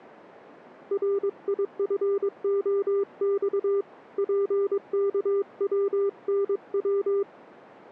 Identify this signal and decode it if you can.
Morse code, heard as a keyed tone, hand-sent with a paddle, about 22 wpm, 400 Hz. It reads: RIFOX PKWNW